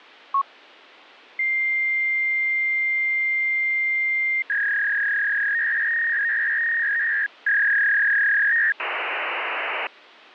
Fax machine handshake, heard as a long tone, a warble and hiss.